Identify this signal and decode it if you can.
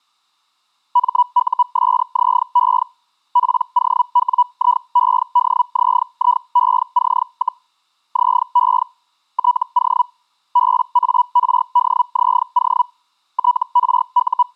Hellschreiber (Feld-Hell, 122.5 baud), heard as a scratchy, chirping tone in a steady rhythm, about 980 Hz. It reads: MUSZE POWIEDZIEC, ZE TO BARDZO …